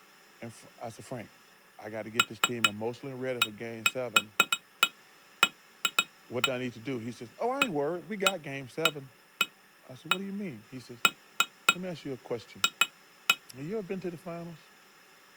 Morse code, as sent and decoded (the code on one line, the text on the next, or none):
none